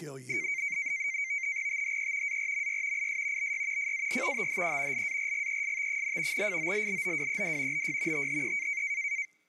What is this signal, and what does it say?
NAVTEX (SITOR-B), 100 baud, 170 Hz shift, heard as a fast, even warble, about 2200 Hz centre, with speech in English. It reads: THE ARMY IS BY FAR THE LARGEST, FOLLOWED BY THE